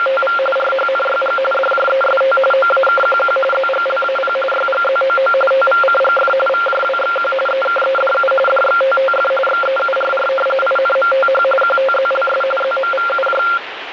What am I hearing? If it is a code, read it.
RTTY (45.45 baud, 850 Hz shift), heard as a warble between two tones, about 960 Hz centre, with radio static. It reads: … RHNYG DJEST OAKQQ ZGLAP YGZOO TVCGF VJWXQ EKEDU DXTTF XEURR INMTH QTZLS ZMVUJ